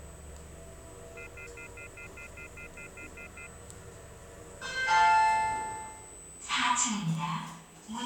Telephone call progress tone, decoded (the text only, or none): off-hook warning tone